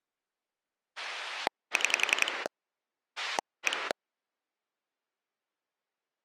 Pulse dialling, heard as a rotary dial, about 11 pulses a second. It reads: 6 1